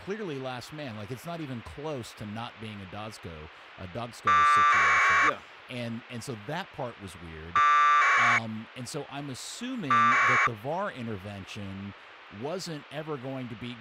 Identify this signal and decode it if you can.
Packet radio (AX.25, as in APRS), 1200 baud, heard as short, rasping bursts, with speech in English.